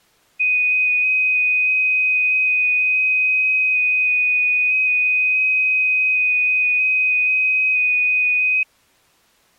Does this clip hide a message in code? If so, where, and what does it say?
Yes: FT8 (one signal) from 0.4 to 8.6 s, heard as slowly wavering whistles, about 6.25 baud.